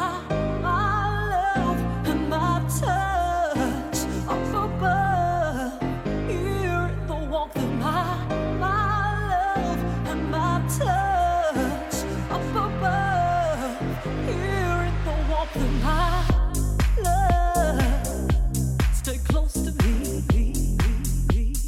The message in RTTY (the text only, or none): none